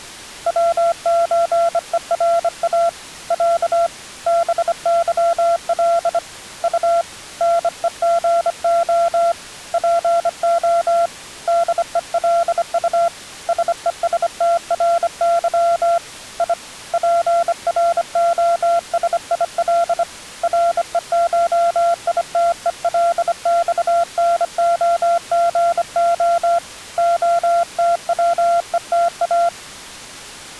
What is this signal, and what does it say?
Morse code (Russian alphabet), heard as a keyed tone, hand-sent with a bug key, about 25 wpm, 680 Hz. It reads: ВЧЕРА Я БЫЛ У НЕГО ПО ДЕЛУ СЕСТРЫ И ПРОСИЛ РЕШИТЕЛЬНОГО ОТВЕТА